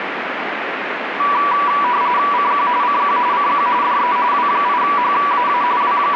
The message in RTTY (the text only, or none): CQ CQ CQ DE W8HAA …